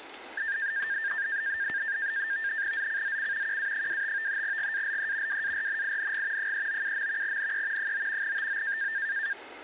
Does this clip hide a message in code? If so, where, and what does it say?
Yes: NAVTEX (SITOR-B), 100 baud, 170 Hz shift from 0.4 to 9.3 s, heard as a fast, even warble, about 1700 Hz centre, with kitchen noise. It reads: ZCZC QA25 GALE WARNING 397. NE 9 TO